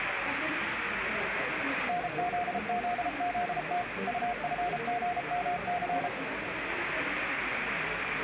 Morse code, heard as a keyed tone, machine-sent, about 33 wpm, 710 Hz, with radio static and the noise of a crowd indoors. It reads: NZZZT UFGMC